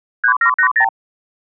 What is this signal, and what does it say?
Multi-frequency trunk signalling (R2, with the far end's replies), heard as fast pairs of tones, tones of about 90 ms. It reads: 3780